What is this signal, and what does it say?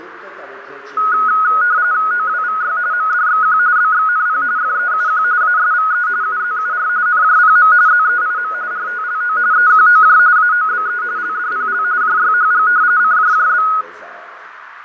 RTTY (45.45 baud, 170 Hz shift), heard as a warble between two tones, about 1360 Hz centre, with radio static, fading and a narrow filter. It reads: OWVY MDXQ BXNP FEUQ ASVE UZUR NJPM ZEIM RTLO EQOJ AOBE LDPL JYHG CJJB